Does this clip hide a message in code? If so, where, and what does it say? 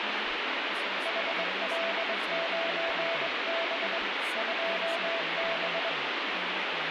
Yes: Morse code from 1.0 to 6.0 s, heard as a keyed tone, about 22 wpm, 670 Hz, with heavy radio static and speech in Assamese. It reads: HL9B 2B